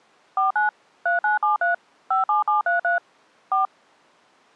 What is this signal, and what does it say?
DTMF, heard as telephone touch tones, dialled by machine, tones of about 140 ms. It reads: 49 3973 57733 4